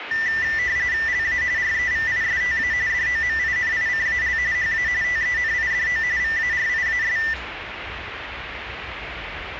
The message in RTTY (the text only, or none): LA REVISTA DOMINICAL HA TENIDO VARIAS